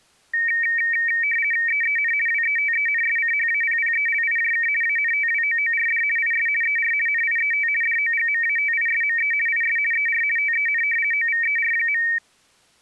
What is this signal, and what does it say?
RTTY (50 baud, 450 Hz shift), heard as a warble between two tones, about 2050 Hz centre. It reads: EEN WETENSCHAPPELIJK ANTWOORD IS ER NIET DOGMATISME IS ER TEN OVER.